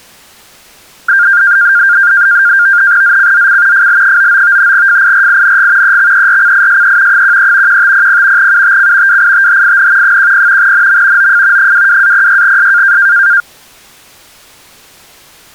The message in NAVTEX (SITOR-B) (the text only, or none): ZCZC FL99 FIRING EXERCISE 13 1500 UTC WITHIN 10 NM OF 22-06S